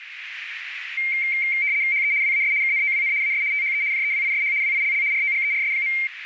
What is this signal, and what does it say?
RTTY (75 baud, 170 Hz shift), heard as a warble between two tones, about 2200 Hz centre, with radio static and a narrow filter. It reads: HE WAS KNOWN AS THE JEWISH WILL ROGERS.